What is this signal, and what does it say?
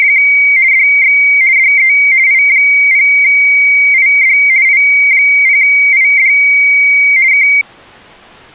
RTTY (50 baud, 170 Hz shift), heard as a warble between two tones, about 2200 Hz centre. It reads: … DX DE I0ID I0ID K